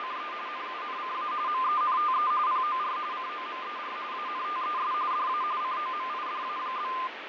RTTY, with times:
0.0-0.3 …
0.5-1.3 NUNCA
1.5-2.3 MENTE
2.5-3.0 POR
3.1-4.0 COMER
4.1-4.9 ANTES
5.1-5.4 DA
5.6-6.9 COMIDA?

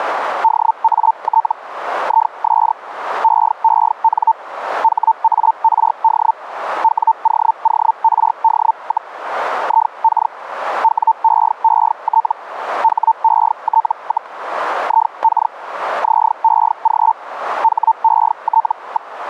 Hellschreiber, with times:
0.4-1.5 DAT
2.0-2.7 IS
3.2-4.3 EEN
4.8-6.3 HARD
6.8-9.1 WOORD,
9.6-10.3 IK
10.8-12.3 WEET
12.8-14.3 HET,
14.8-15.5 IK
16.0-17.1 ZEG
17.6-19.1 HET.

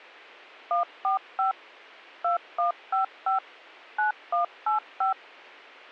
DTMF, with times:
0.7-1.5 145
2.2-3.4 2155
4.0-5.1 9185

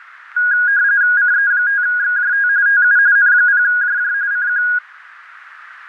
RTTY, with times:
1.2-2.5 CE5XJT
2.7-3.0 TU
3.2-4.1 N0JJ
4.3-4.6 CQ

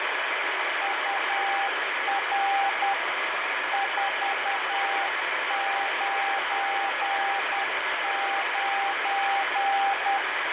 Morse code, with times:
0.8-2.9 UR
3.7-10.2 499

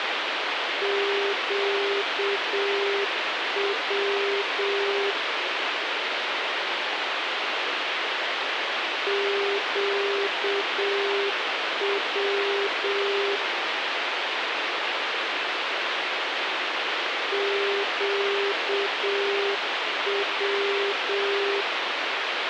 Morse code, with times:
0.8-5.1 QW
9.1-13.4 QW
17.3-21.6 QW

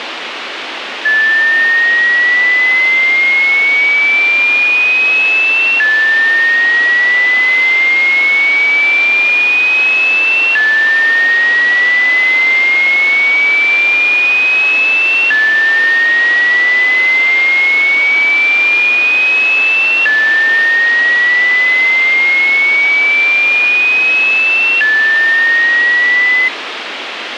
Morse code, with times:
none

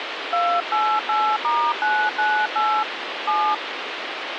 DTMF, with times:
0.3-2.8 288*998
3.3-3.5 7

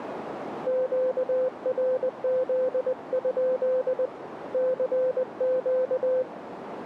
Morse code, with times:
0.7-4.1 QRZ?
4.5-6.2 CQ

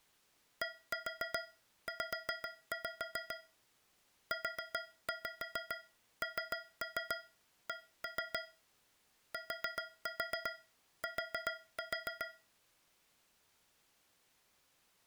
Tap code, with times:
0.6-3.4 DZ
4.3-8.4 UNC
9.3-12.3 TT

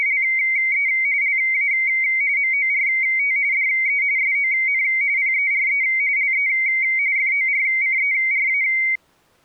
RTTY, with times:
0.0-0.9 …
1.2-1.7 LA
2.4-3.4 MORT
3.5-4.0 DE
4.2-4.8 SON
5.2-5.8 PERE
6.2-6.5 LE
7.2-8.6 FORCERA

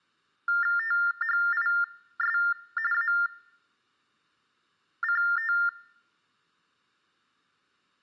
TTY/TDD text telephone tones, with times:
0.8-2.4 THIS
2.9-5.5 ACT

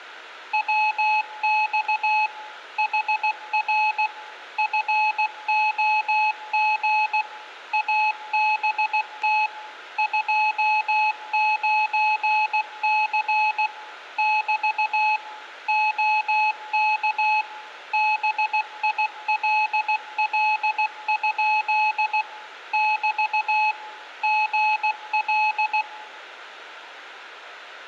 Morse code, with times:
0.5-2.3 WX
2.8-4.1 HR
4.6-7.2 FOG
7.7-9.5 ABT
10.0-13.7 29C
14.2-15.2 <BT>
15.7-17.4 OK
17.9-22.2 BILL?
22.7-23.7 <BT>
24.2-25.8 GL

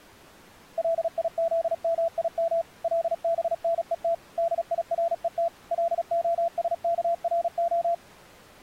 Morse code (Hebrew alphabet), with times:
0.8-2.6 ליזמים
2.8-4.1 לבנות
4.4-5.5 דירות
5.7-7.9 להשכרה

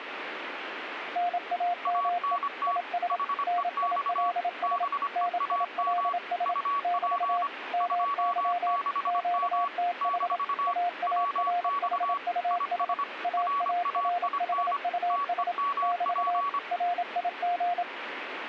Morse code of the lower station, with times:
1.2-2.4 NAME
2.7-3.2 IS
3.5-4.8 NILS
5.2-6.5 NILS
6.8-7.4 <BT>
7.7-8.8 MY
9.1-10.4 QTH
10.7-12.9 AARHUS
13.2-15.5 AARHUS
15.8-16.4 <BT>
16.7-17.8 RIG

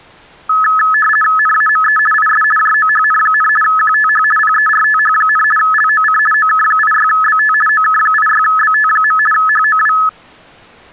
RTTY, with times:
1.4-2.0 NAME
2.1-2.4 IS
2.6-3.5 JOHN,
3.6-4.2 QTH
4.4-5.4 PERTH,
5.6-6.2 LOC
6.3-7.5 OK86BT
7.7-9.2 OK86BT.
9.3-9.9 HOW

